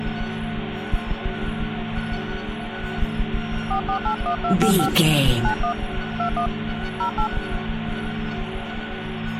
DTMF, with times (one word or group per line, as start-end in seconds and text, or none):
3.7-4.9 4481255
5.4-5.7 91
6.2-6.5 21
7.0-7.3 08